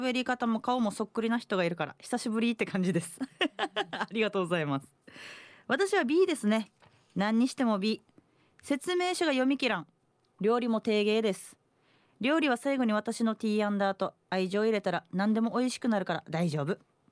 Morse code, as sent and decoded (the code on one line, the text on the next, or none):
none